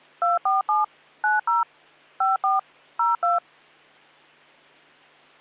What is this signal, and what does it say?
DTMF, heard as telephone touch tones, dialled by machine, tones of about 160 ms. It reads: 247 90 54 02